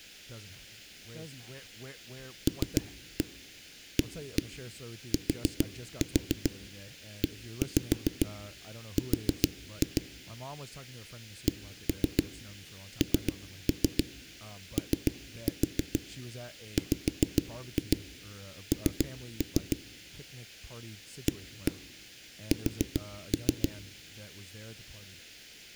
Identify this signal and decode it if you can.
Tap code, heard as knocks on a wall, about 7 knocks a second, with speech in English. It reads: LATER KNOWN AS